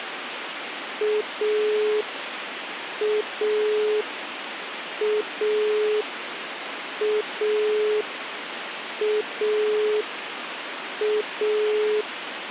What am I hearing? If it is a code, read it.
Telephone call progress tone (pulsed, as in Italy), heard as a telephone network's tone, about 420 Hz, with phone line noise. Dial tone.